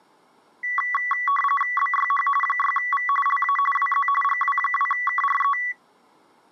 RTTY (45.45 baud, 850 Hz shift), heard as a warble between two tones, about 1550 Hz centre. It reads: BYH 6V LA WZ GW2KRE